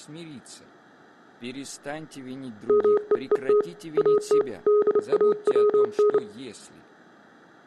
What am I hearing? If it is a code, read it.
Morse code, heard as a keyed tone, hand-sent with a bug key, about 29 wpm, 420 Hz. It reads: MEET AT DAWN